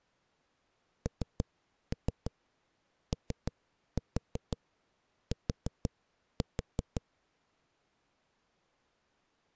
Tap code, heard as knocks on a wall, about 6 knocks a second. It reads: NOT